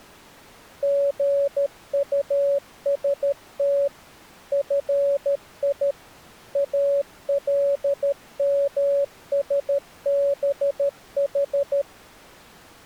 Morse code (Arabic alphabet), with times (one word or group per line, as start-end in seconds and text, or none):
0.8-3.9 غطست
4.5-5.9 في
6.6-11.8 المسبح